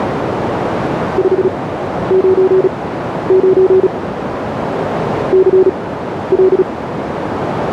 Morse code, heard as a keyed tone, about 36 wpm, spaced as for 12 wpm, 380 Hz, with radio static and a narrow filter. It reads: 599 CL